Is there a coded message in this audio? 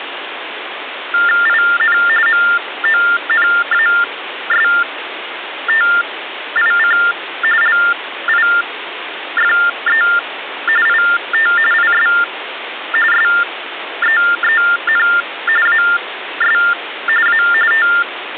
Yes: TTY/TDD text telephone tones (45.45 baud Baudot) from 1.1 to 18.4 s, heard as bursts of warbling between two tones, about 400 Hz shift, 1600 Hz centre, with phone line noise. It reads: IN MONASTIC LIFE IT IS SEEN AS A …